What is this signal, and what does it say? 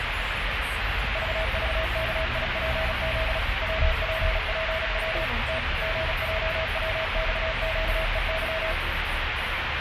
Morse code, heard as a keyed tone, machine-sent, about 36 wpm, 640 Hz, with radio static and the noise inside a car. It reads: VVKIPZ WPPW T GJWXQEY